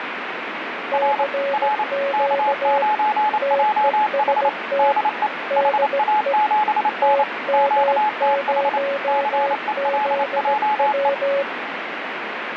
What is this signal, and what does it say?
Morse code, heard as two keyed tones, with radio static. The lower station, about 17 wpm, 560 Hz: CQ TEST DE TM0ZW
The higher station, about 28 wpm, 850 Hz: R R K9JH DE HA7N QTH CELJE